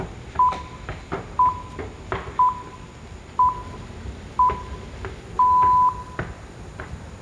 Radio time signal (six pips, as the Greenwich Time Signal), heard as pips, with room echo and the noise of a subway station.